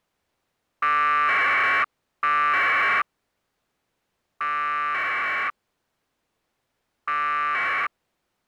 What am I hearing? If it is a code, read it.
Packet radio (AX.25, as in APRS), 1200 baud, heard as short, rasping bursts.